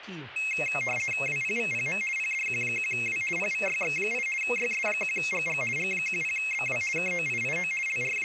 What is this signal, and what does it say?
RTTY (50 baud, 450 Hz shift), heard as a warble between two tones, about 2350 Hz centre, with speech in Portuguese. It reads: WPVPM PDQ1W PVYX8 YS1GG G10BW KOIIO …